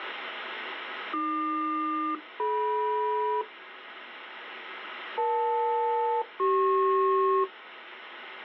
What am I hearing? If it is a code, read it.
Aircraft SELCAL, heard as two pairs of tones. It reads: AQ-DM EL-CP